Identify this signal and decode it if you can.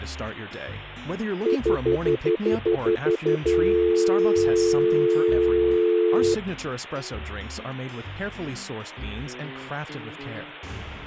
Telephone call progress tone (North American plan), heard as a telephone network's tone, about 350, 440 Hz, 0.1 s on and 0.1 s off. Stutter dial tone.